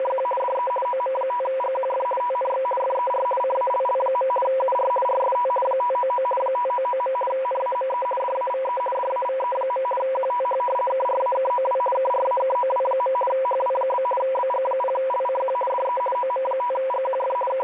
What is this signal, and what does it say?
RTTY (50 baud, 450 Hz shift), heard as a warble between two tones, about 750 Hz centre, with radio static. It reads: … DE OM5GQF TNX FER CALL. UR RST 599 599. NAME DAVE DAVE. QTH KRAKOW KRAKOW. HW? BG0LCQ DE OM5GQF …